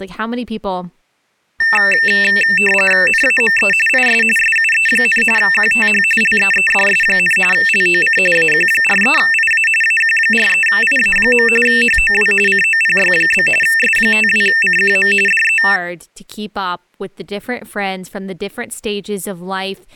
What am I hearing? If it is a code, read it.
RTTY (45.45 baud, 850 Hz shift), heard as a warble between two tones, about 2250 Hz centre, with speech in English. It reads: NAME IS SUE, QTH LEEDS, LOC AQ43IA AQ43IA. HOW COPY? S52CQM DE